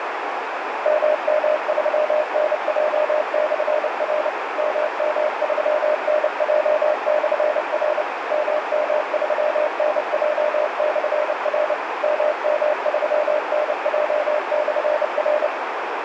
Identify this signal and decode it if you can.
Morse code, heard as a keyed tone, machine-sent, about 29 wpm, 610 Hz, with radio static and a narrow filter. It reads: MM3NJ/R MM3NJ/R MM3NJ/R MM3NJ/R